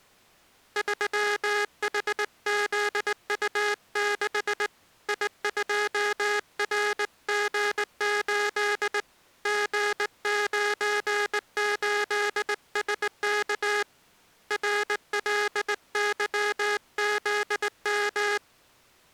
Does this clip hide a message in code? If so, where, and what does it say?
Yes: Morse code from 0.7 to 18.4 s, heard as a buzzer, hand-sent with a straight key, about 19 wpm. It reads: 3HZU6 I2RG8 G98SK RLYZM